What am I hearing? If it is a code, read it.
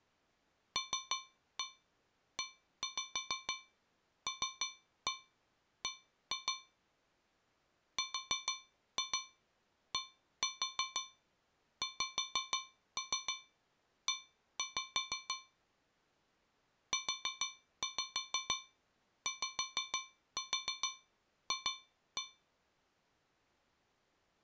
Tap code, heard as taps on a metal pipe, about 6 knocks a second. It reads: LELB RDXE UYF